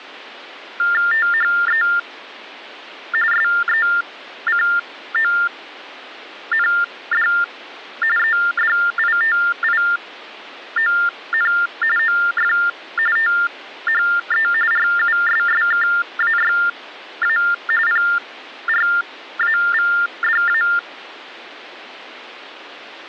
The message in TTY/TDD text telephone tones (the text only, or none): THE SECOND EDITION OF THE RUSSKAYA PRAVDA